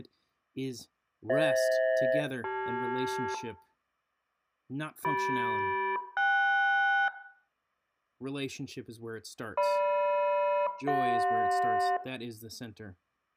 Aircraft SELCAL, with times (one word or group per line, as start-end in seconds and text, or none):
1.3-3.3 FH-CL
5.0-7.1 CM-KS
9.6-12.0 GM-CJ